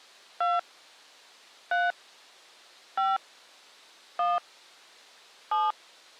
DTMF, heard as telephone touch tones, dialled by hand, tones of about 190 ms. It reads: 2 3 5 1 7